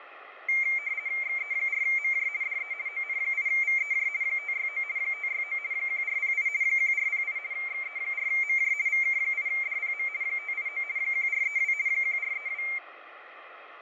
RTTY (50 baud, 170 Hz shift), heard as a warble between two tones, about 2200 Hz centre, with radio static and fading. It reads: XE4MJ DE ON8VEJ 569 569 1408 1408 XE4MJ VK8DPM 589 1432 1432